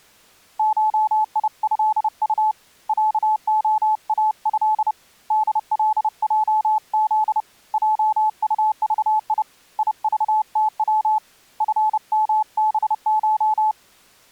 Morse code (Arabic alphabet), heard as a keyed tone, hand-sent with a paddle, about 30 wpm, 860 Hz. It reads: شيهط عخاه دلجذ جطضي يضتو فمبش